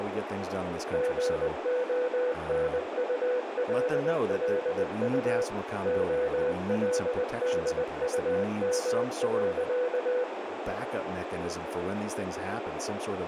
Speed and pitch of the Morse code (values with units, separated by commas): 20 wpm, 500 Hz